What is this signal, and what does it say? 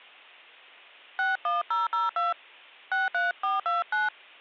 DTMF, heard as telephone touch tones, dialled by hand, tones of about 160 ms. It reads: 61002 63429